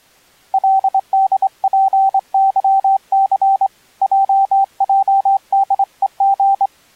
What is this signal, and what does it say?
Morse code, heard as a keyed tone, hand-sent with a straight key, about 25 wpm, 780 Hz. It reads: LDPYC JJDEG